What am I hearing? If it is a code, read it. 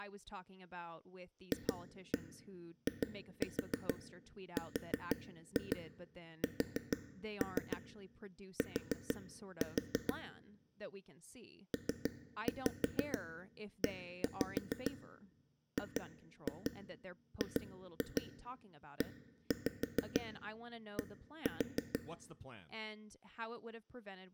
Tap code, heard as taps on a table, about 6 knocks a second, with speech in English. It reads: FIRST PEGGED